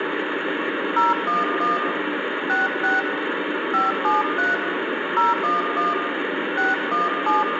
DTMF, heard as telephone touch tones, dialled by hand, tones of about 170 ms, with phone line noise and room echo. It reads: 011 66 573 011 617